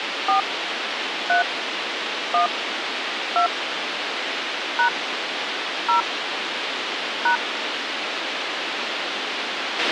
DTMF, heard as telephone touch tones, dialled by hand, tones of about 110 ms, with radio hiss and a squelch burst at the end. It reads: 4 3 1 2 # 0 #